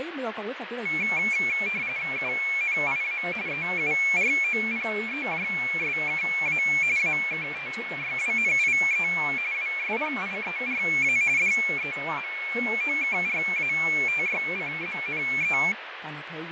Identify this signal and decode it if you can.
RTTY (45.45 baud, 170 Hz shift), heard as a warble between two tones, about 2300 Hz centre, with radio static and fading. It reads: UNIA EUROPEJSKA AKTYWNIE WSPIERA DEMOKRATYCZNE